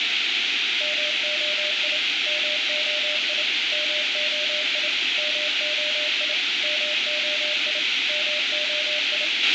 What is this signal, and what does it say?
Morse code, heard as a keyed tone, machine-sent, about 28 wpm, 600 Hz, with radio hiss, a squelch burst at the end and room echo. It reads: MOI MOI MOI MOI MOI MOI